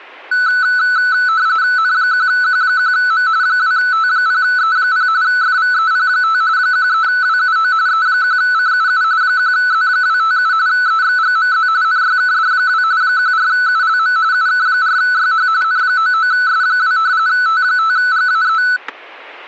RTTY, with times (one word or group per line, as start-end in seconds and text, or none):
1.8-3.3 N1Q1M
3.4-5.1 2T0E0
5.2-6.4 FVEP5
6.6-7.7 13WUO
7.9-9.0 E1CUU
9.2-10.5 1Z257
10.7-11.7 EXGMZ
11.8-12.8 NYKD2
13.0-14.2 14ULM
14.3-15.5 UK4YH
15.6-17.0 N99S2
17.3-18.6 T5GAE